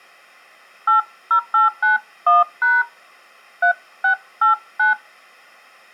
DTMF, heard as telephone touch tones, dialled by hand, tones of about 140 ms. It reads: 80891# 3689